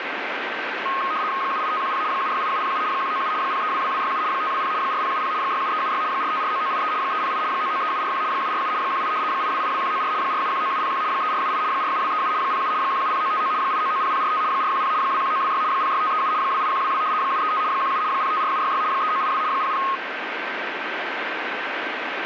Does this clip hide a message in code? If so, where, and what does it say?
Yes: RTTY (75 baud, 170 Hz shift) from 0.9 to 20.0 s, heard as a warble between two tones, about 1170 Hz centre, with radio static and a steady whistle near 1560 Hz. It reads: 78510 768707 197 0322267 520 4070 67376 4549983 308 993741 747 18 8282194 4719701 3478 47237 07 170959 8990045 410 21926 06537 28122 735 17 054766 3982 00